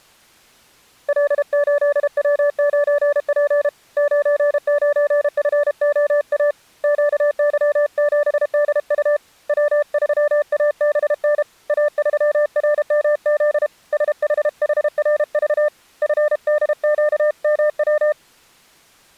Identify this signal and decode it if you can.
Morse code, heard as a keyed tone, hand-sent with a paddle, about 32 wpm, 590 Hz. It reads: L8W9P 99FOA QY7DU W3ABN A3RMZ SHHRV FDQMW